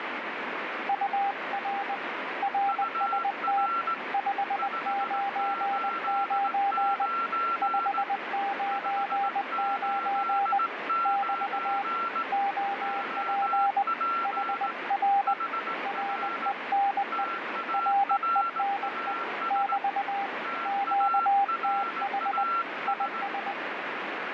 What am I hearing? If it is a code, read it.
Morse code, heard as two keyed tones, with heavy radio static. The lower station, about 20 wpm, 800 Hz: UR RST 599 599 <BT> OP HR RENE RENE <BT> QTH IS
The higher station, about 18 wpm, 1360 Hz: UR 589 589 OP HR TARAS TARAS